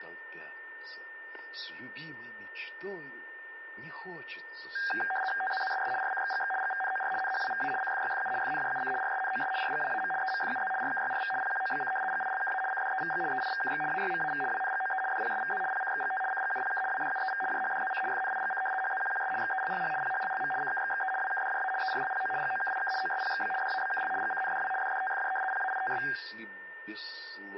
RTTY (75 baud, 850 Hz shift), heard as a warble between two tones, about 1180 Hz centre, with static crashes and a steady whistle near 1810 Hz. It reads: TZZSS RCXGX GVNOR NHWVA CFYFU FNJUC RSNOS RGWAM EMFUZ RKYRV PQOBC GILKA CDEVG EIVKX AYMAV WNGOE DPSVZ PCXGT CGUPK WDUEV JHDZC FNIGC HZQQS XELLH PHLLM CKXXE WKDJA ERLPO GOKIK OSPXB DABKL GCNDW DDTFJ PAITS